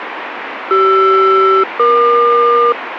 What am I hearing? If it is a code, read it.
Aircraft SELCAL, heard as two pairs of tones, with radio static. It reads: CR-EQ